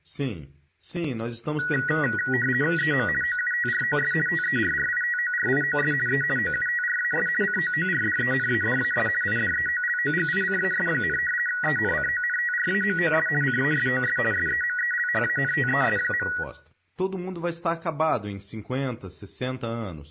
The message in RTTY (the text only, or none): EM OUTROS TERRITORIOS E OUTRAS COORDENADAS IDEOLOGICAS, ENCONTRAMOS CASOS SEMELHANTES.